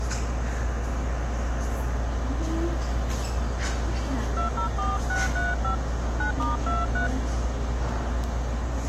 DTMF, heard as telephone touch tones, dialled by hand, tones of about 150 ms, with the noise of a subway station. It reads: 204635 9*23